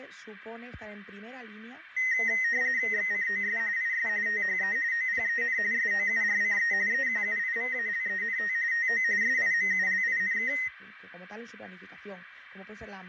RTTY (45.45 baud, 170 Hz shift), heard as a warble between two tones, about 1950 Hz centre, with radio static and room echo. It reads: XCOS IS THE OPEN SOURCE EQUIVALENT TO SIMULINK